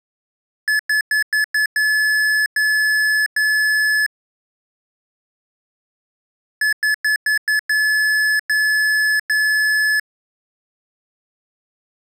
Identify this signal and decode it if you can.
Beep code, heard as beeps from a small speaker, played twice, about 1700 Hz. 5 short, 3 long.